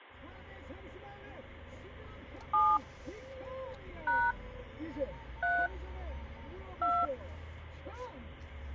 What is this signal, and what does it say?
DTMF, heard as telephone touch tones, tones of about 240 ms, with the noise inside a car. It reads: 7 # 3 2